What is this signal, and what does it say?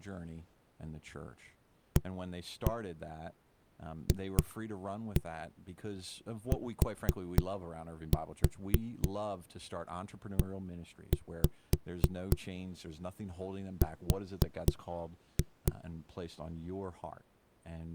Tap code, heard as knocks on a wall, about 3 knocks a second, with speech in English. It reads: AFTER